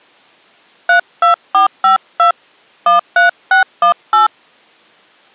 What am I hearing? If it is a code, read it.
DTMF, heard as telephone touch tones, dialled by hand, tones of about 120 ms. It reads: 32452 13618